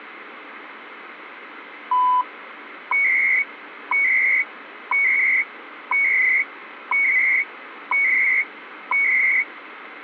Radio time signal (CHU, Canada), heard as beeps and data bursts, one a second, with radio static.